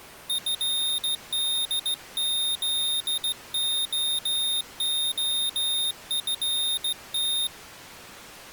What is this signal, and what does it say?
Morse code, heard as a high beeper, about 16 wpm, 3700 Hz. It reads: FDZOOFT